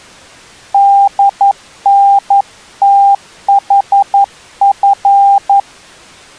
Morse code (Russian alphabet), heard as a keyed tone, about 11 wpm, 800 Hz. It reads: ДНТХФ